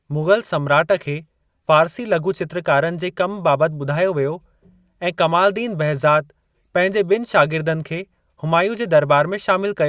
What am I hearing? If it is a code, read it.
Speech in Sindhi. There is no code.